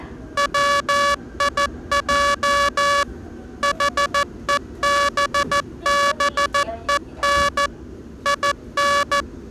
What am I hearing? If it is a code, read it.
Morse code, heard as a buzzer, machine-sent, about 14 wpm, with the noise inside a subway train. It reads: WIJ HEBBEN IN